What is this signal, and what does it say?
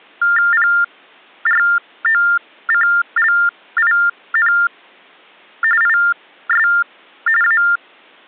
TTY/TDD text telephone tones (45.45 baud Baudot), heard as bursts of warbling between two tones, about 400 Hz shift, 1600 Hz centre. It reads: PROCLIN IS A